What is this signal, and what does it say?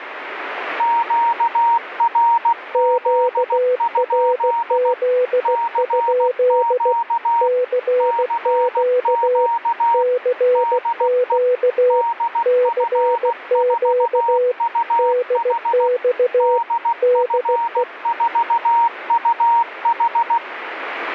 Morse code, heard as two keyed tones, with radio static. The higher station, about 16 wpm, 930 Hz: QRZ? CQ CQ DE DF4UH DF4UH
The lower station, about 16 wpm, 500 Hz: QRZ? CQ CQ CQ DX DE